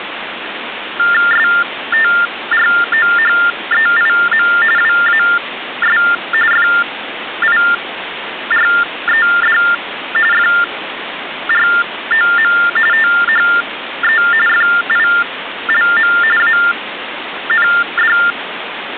TTY/TDD text telephone tones (45.45 baud Baudot), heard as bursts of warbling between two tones, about 400 Hz shift, 1600 Hz centre, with phone line noise. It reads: STROHEIM WAS FIRED FROM THE FILM AND